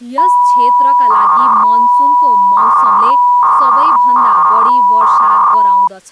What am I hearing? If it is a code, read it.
300-baud modem data (V.21 tones), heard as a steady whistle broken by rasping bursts, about 300 baud, 200 Hz shift, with speech in Nepali.